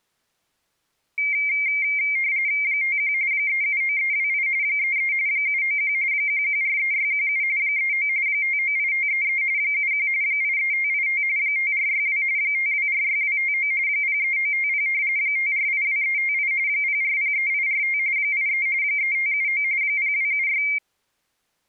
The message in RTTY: 51 379328 33 791 1143617 39 598533 71 83585 5462 5246259 03950 5482358 0403845 83 3579 0276

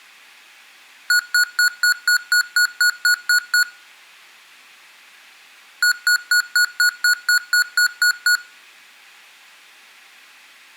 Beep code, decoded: 11 short

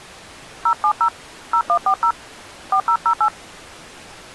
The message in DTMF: 070 0140 4008

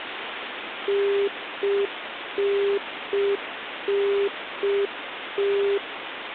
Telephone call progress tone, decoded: congestion tone

